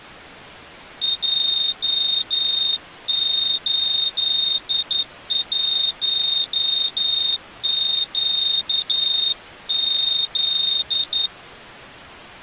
Morse code, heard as a high beeper, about 11 wpm, 3700 Hz. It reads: J81QZ